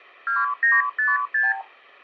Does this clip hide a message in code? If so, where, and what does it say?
Yes: multi-frequency trunk signalling (R2, with the far end's replies) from 0.3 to 1.6 s, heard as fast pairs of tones, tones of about 180 ms. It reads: 2956